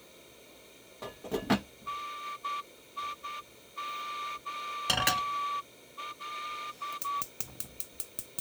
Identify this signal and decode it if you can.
Morse code (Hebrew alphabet), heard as a whistle, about 10 wpm, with kitchen noise. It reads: ניהל